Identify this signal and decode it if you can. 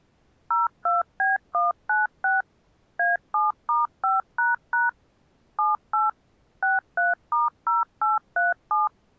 DTMF, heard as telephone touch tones, dialled by machine, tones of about 160 ms. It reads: 02B196 A7*5## 78 63*0837